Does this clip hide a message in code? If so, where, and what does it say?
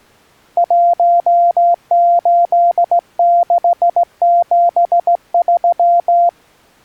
Yes: Morse code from 0.5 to 6.4 s, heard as a keyed tone, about 16 wpm, 690 Hz. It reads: 18673